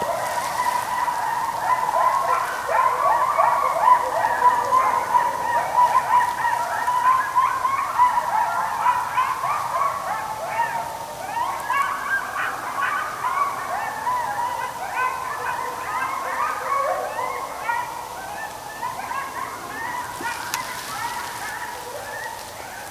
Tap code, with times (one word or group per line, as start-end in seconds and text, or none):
none